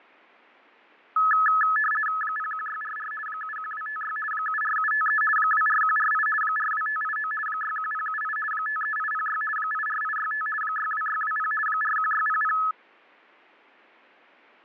RTTY (50 baud, 450 Hz shift), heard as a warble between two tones, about 1500 Hz centre, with fading. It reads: 01644 71256 74753 24148 42589 61078 53806 84865 62620 41600